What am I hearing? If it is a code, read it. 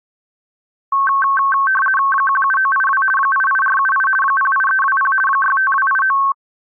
RTTY (50 baud, 450 Hz shift), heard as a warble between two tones, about 1320 Hz centre. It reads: 17982 88478 08320 65289